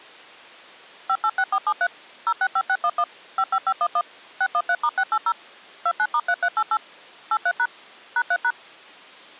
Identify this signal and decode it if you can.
DTMF, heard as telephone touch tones, dialled by machine, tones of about 60 ms. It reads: 586473 065611 55511 613*680 29*3388 83# #3#